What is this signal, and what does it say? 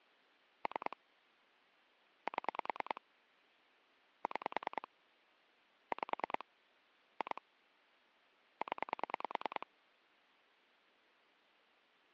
Pulse dialling, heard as clicks on a phone line, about 10 pulses a second. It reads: 3 7 6 5 2 0